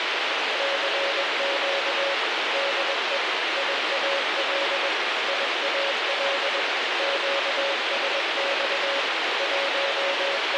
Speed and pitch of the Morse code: 21 wpm, 560 Hz

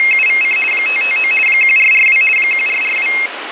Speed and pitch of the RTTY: 50 baud, 450 Hz shift, 2350 Hz centre

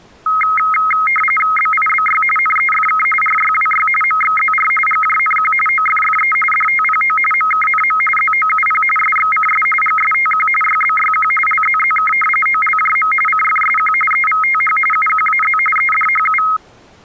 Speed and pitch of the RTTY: 45.45 baud, 850 Hz shift, 1700 Hz centre

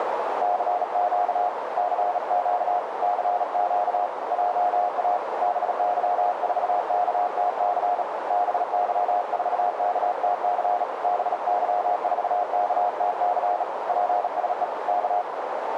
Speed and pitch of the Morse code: 37 wpm, 720 Hz

